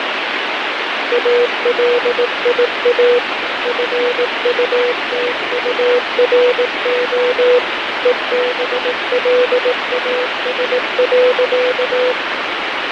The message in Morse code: ALIA FUTURO EBLAS.

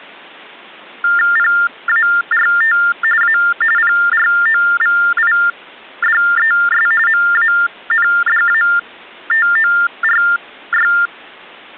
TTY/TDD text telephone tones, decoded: PART A PROVIDES MANDATORY

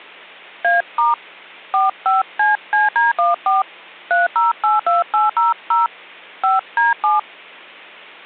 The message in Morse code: none

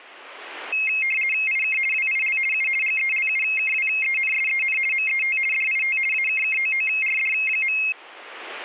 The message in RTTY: IK WIL U GELUKWENSEN MET DIT AKKOORD.

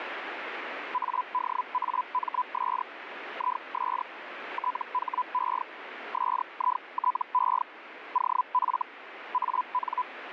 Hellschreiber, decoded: ADAMS IS THE SITE OF AN

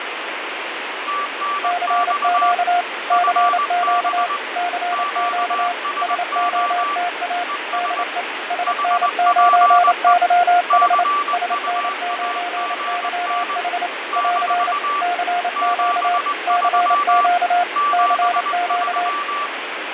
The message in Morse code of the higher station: TNX FB QSO ES HPE CUAGN - 73 73

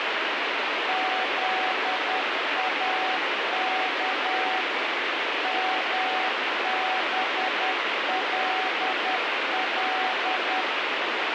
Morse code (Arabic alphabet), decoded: ذاك مبلل

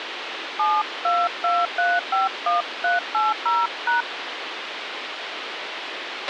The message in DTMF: 722351380#

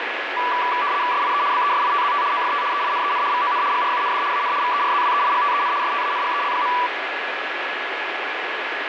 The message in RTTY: SIE BESITZT OFT EINEN VON GRUND AN VERZWEIGTEN STANGEL.

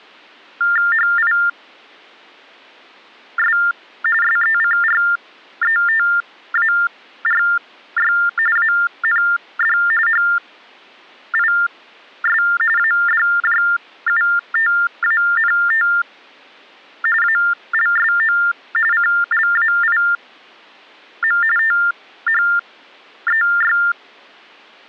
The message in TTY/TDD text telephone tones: HIS SECRETARY AND HIS ADJUTANT ALSO CLAIM THEY

